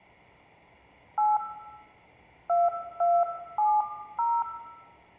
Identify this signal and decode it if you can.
DTMF, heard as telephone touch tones, dialled by hand, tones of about 220 ms, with room echo. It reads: 8 2270